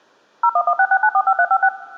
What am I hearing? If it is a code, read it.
DTMF, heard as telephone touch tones, dialled by machine, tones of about 60 ms. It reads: 01166945356